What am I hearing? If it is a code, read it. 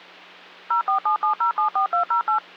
DTMF, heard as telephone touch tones, dialled by machine, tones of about 110 ms, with hum. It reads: 0477074208